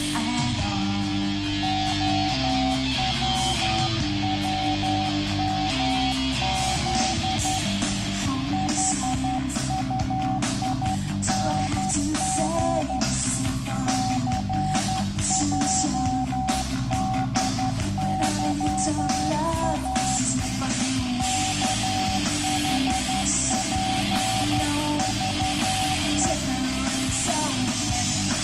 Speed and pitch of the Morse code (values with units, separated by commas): 11 wpm, 760 Hz